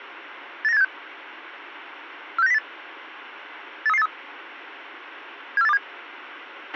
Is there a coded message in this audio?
Yes: five-tone selective call (EEA) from 0.6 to 5.8 s, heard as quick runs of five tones, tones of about 40 ms, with a squelch burst at the end. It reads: 89876 46908 83383 74827